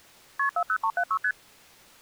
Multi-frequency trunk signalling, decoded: KP 40376 ST

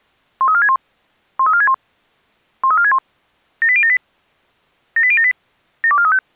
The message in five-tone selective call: 13461 13461 13461 78078 78078 72435

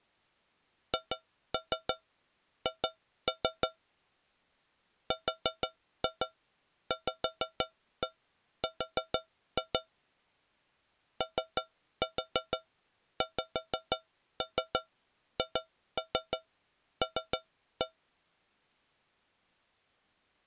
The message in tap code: HH RVR OXHL

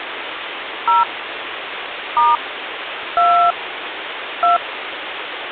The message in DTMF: 0 * 2 2

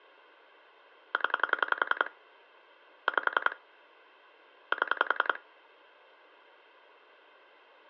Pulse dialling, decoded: 0 5 7

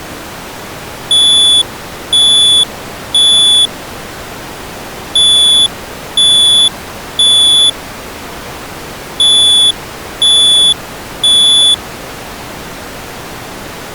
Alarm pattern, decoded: temporal three

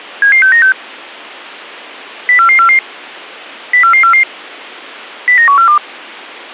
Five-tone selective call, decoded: 77696 04444 04444 09142

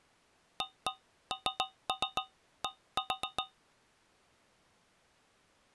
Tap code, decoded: AND

